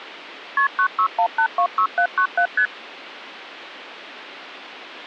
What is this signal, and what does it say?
Multi-frequency trunk signalling (R1, as on North American trunks), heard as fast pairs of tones, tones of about 80 ms. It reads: KP 961826797 ST